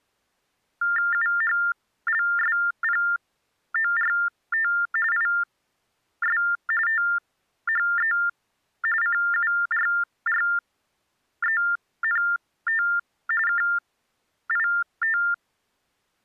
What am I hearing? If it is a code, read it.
TTY/TDD text telephone tones (45.45 baud Baudot), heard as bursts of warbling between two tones, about 400 Hz shift, 1600 Hz centre. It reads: UHLSPORT IS THE CURRENT KIT